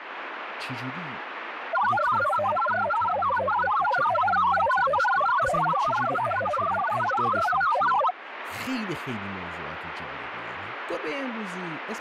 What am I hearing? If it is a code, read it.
Multi-tone FSK (Olivia or MFSK type), about 1000 Hz wide, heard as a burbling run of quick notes, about 62.5 baud, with radio static and speech in Persian.